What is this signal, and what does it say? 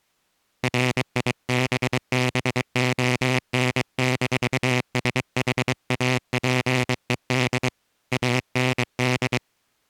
Morse code, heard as a buzzer, hand-sent with a paddle, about 23 wpm. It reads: RIBBON-SHAPED AND